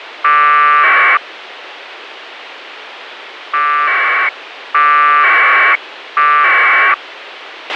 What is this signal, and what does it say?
Packet radio (AX.25, as in APRS), 1200 baud, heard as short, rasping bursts, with radio hiss and a squelch burst at the end.